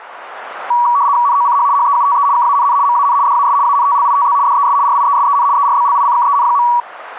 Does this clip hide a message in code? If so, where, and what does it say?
Yes: RTTY (75 baud, 170 Hz shift) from 0.7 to 6.8 s, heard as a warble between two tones, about 1050 Hz centre. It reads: NOCH HEUTE KANN MAN DAS ANTLITZ DES RIESEN ERBLICKEN.